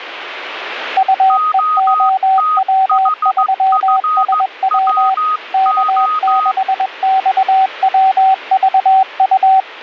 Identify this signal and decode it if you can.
Morse code, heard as two keyed tones, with radio static. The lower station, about 21 wpm, 760 Hz: UEOW3SW K6XWVU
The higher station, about 15 wpm, 1250 Hz: OTHFWO